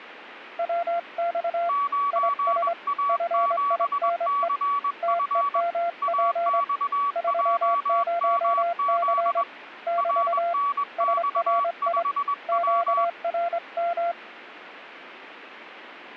Morse code, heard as two keyed tones. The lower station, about 24 wpm, 690 Hz: WX IS FINE TEMP 30C <BT> SRI QRM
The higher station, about 21 wpm, 1140 Hz: 9A7CF AXJMZ RNX5W